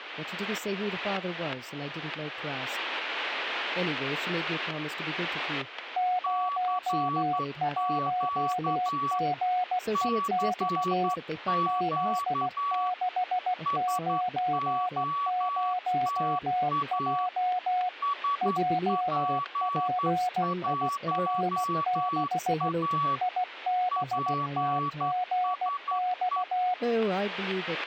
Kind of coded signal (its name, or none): Morse code